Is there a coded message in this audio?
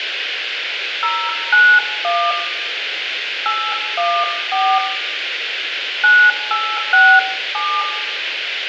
Yes: DTMF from 1.0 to 7.8 s, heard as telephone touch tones, dialled by hand, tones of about 270 ms, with phone line noise and room echo. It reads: 091 814 9867